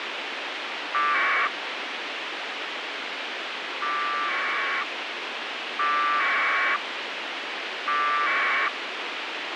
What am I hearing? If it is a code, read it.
Packet radio (AX.25, as in APRS), 1200 baud, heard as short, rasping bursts, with radio hiss and a squelch burst at the end.